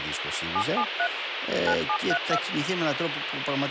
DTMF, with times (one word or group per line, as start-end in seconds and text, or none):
0.6-1.1 773
1.7-2.4 9732